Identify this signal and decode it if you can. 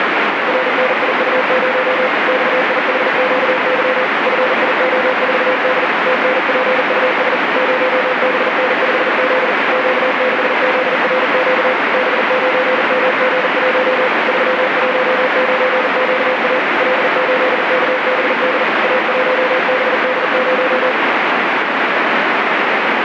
Morse code, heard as a keyed tone, machine-sent, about 40 wpm, 510 Hz, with heavy radio static. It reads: RNIU0 XIHQY FIO4D TNPUS 0BN5Z Q6ZRQ B9MG1 319QA L8KBD A1BD0